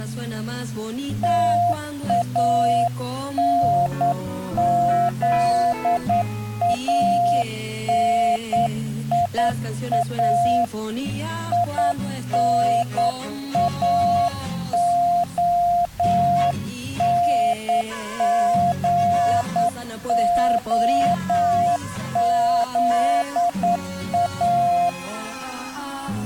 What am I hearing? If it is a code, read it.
Morse code, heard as a keyed tone, hand-sent with a straight key, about 9 wpm, 700 Hz. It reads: TANZANIA INAONGOZA